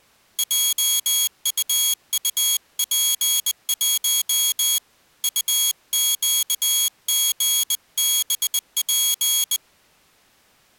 Morse code, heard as a high beeper, hand-sent with a bug key, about 20 wpm, 3300 Hz. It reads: JUUP1 UQGBP